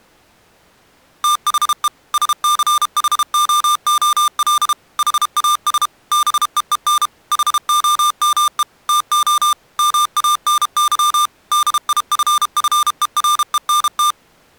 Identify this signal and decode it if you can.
Morse code, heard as electronic beeps, machine-sent, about 32 wpm, 1200 Hz. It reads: THE SCHOOL HAS BEEN HOME TO MANY DIFFERENT